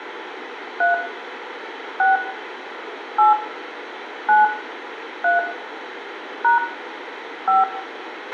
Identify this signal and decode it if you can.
DTMF, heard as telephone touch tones, dialled by hand, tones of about 140 ms, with radio hiss, a squelch burst at the end and room echo. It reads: 3 6 8 9 3 # 5